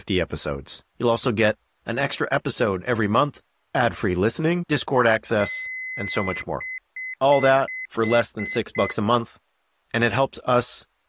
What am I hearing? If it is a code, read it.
Beep code, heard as beeps, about 2050 Hz, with speech in English. 1 long, 7 short.